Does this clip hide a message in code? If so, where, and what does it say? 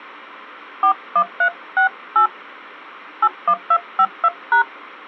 Yes: DTMF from 0.8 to 4.6 s, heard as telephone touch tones, dialled by hand, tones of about 80 ms. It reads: 41368 81252#